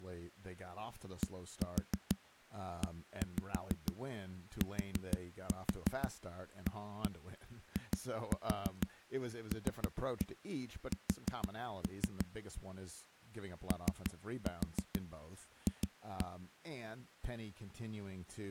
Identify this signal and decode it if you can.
Tap code, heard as knocks on a wall, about 6 knocks a second, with speech in English. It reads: DETAILS OF